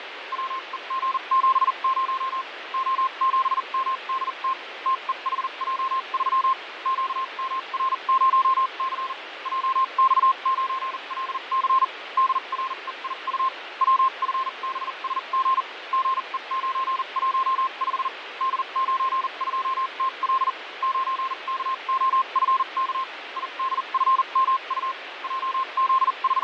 Morse code, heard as a keyed tone, machine-sent, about 40 wpm, spaced as for 33 wpm, 1060 Hz, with radio static and fading. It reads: WEG70 O7MDT TEHJ3 QMR0C JX9LC DREIU WFBSG GE915 D92TL 9KOFK IDFMU …